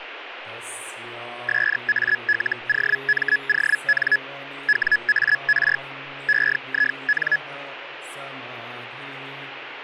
Hellschreiber (Feld-Hell, 122.5 baud), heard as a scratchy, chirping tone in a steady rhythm, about 1700 Hz, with radio static. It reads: SALOMON WAR EIN